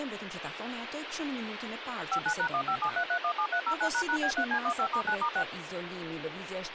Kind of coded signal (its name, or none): DTMF